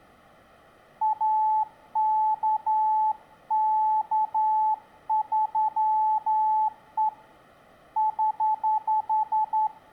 Morse code, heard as a keyed tone, hand-sent with a straight key, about 11 wpm, 870 Hz, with room echo. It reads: AKK3E <HH>